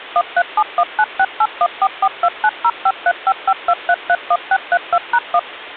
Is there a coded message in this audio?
Yes: DTMF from 0.2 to 5.4 s, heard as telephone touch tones, dialled by machine, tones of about 60 ms. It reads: 137196814429053552331632#1